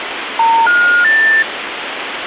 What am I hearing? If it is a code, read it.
Telephone call progress tone (North American plan), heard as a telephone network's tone, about 910, 1430, 1800 Hz, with phone line noise. Special information tone.